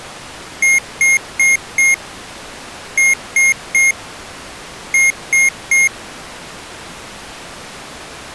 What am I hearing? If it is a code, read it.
Beep code, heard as beeps from a small speaker, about 2150 Hz. 4-3-3. In Phoenix BIOS tables: timer channel 2 failure.